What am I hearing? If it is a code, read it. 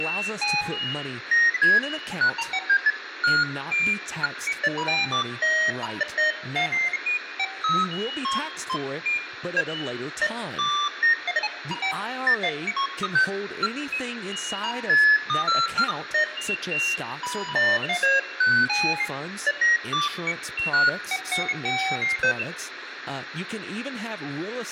Electronic bleeps of random pitch and length, with radio static and speech in English. There is no code.